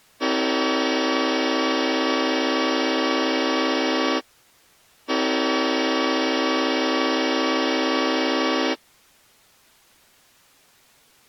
Train horn signal, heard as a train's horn. 2 long. On North American railways: brakes released, proceed.